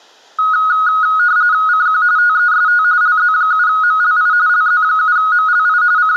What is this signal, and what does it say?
RTTY (45.45 baud, 170 Hz shift), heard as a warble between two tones, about 1360 Hz centre. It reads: CQ TEST LZ7MLI LZ7MLI …